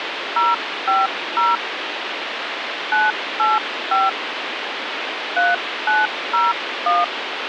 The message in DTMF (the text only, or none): 050 985 3901